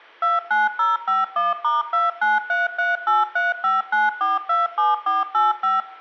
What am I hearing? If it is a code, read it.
DTMF, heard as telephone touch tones, dialled by machine, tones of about 170 ms, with room echo. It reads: 29051*29338359427485